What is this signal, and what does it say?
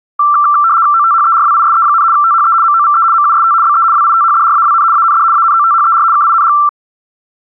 RTTY (75 baud, 170 Hz shift), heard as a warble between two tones, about 1260 Hz centre. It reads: OTHERWISE, THE MOVE MUST BE WITHDRAWN AND ANOTHER KING